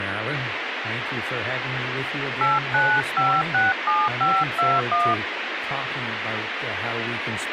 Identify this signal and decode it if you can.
DTMF, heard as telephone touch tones, dialled by hand, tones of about 230 ms, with radio hiss and speech in English. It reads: 89567521